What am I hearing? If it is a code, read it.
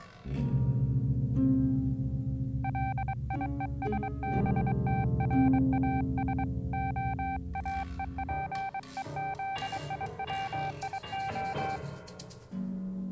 Morse code (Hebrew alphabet), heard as a keyed tone, hand-sent with a paddle, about 23 wpm, 780 Hz. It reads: ליושבתראש האופוזיציה